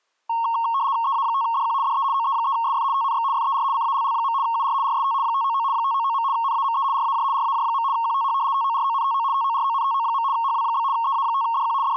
RTTY (75 baud, 170 Hz shift), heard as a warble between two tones, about 1010 Hz centre. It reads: EA5DQ DE OE3SF TNX FER CALL. UR RST 599 599. NAME RAJ RAJ. QTH TORONTO TORONTO. HW? EA5DQ …